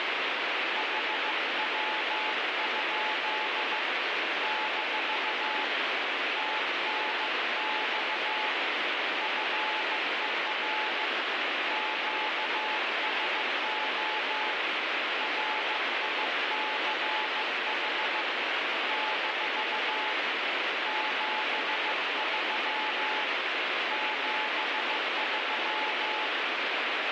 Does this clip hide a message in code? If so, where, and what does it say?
Yes: Morse code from 0.7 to 26.3 s, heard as a keyed tone, hand-sent with a bug key, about 15 wpm, 860 Hz, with heavy radio static. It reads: HW? - TNX FER QSO RICH - 73 73